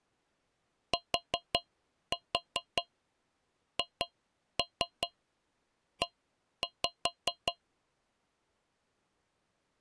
Tap code, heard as taps on a metal pipe, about 5 knocks a second. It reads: THE